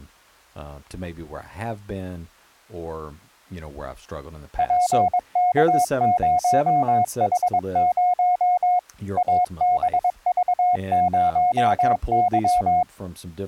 Morse code, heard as a keyed tone, machine-sent, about 22 wpm, 720 Hz, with speech in English. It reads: PK0H0 ABV0Y